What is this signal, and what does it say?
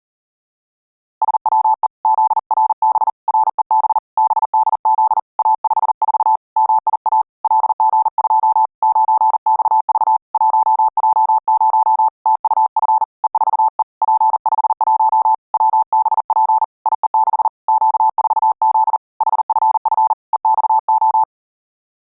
Morse code, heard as a keyed tone, hand-sent with a paddle, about 40 wpm, 880 Hz. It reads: SWE ZRB REB BDZ A54 MIA LG2 9XV 1J0 TUF E4E P51 WBP IE6 Q4Z HFF EXO